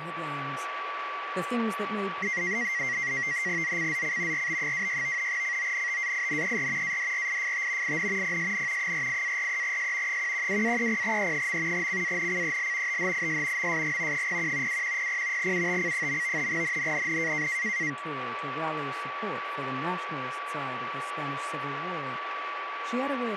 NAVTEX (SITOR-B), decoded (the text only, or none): ZCZC RB26 CONTAINER ADRIFT IN PSN 48-43S 112-30E. CANCEL THIS MSG 01 2100 UTC. NNNN